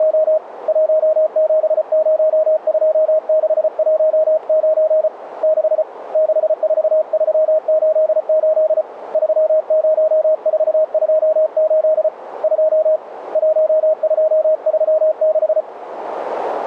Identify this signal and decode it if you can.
Morse code, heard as a keyed tone, hand-sent with a paddle, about 34 wpm, 630 Hz, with radio static. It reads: … 1702619 6 64388 30428 2 1236